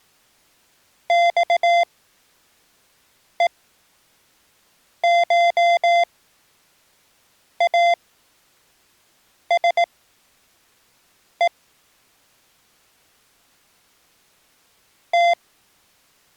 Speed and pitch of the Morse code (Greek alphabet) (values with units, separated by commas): 18 wpm, spaced as for 5 wpm, 690 Hz